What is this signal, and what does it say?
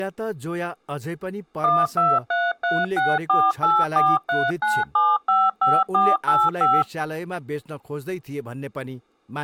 DTMF, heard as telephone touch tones, dialled by machine, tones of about 220 ms, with speech in Nepali. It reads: 1233648439755485